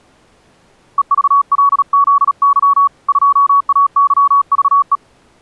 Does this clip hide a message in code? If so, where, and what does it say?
Yes: Morse code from 0.9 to 5.0 s, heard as a keyed tone, hand-sent with a paddle, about 37 wpm, 1120 Hz. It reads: EVLZY 2AYVE